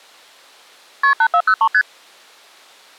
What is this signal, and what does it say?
Multi-frequency trunk signalling (R1, as on North American trunks), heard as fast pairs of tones, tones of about 70 ms. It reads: KP 8403 ST